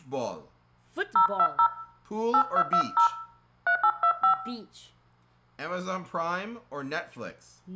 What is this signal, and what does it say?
DTMF, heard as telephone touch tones, dialled by hand, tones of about 80 ms, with room echo and speech in English. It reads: 020 8220 3825